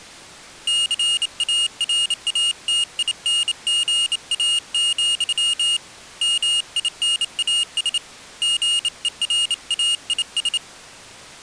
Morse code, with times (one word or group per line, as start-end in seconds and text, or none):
0.7-5.8 CARATINGA,
6.2-8.0 MINAS
8.4-10.6 GERAIS